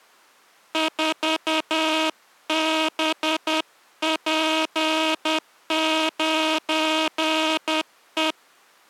Morse code, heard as a buzzer, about 10 wpm. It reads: 4BP9E